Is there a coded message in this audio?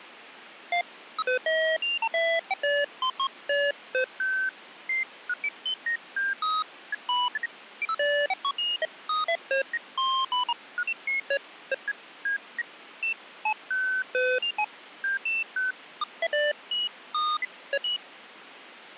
No, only electronic bleeps of random pitch and length, with phone line noise.